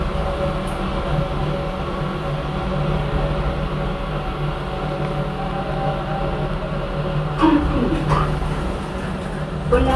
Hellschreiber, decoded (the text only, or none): none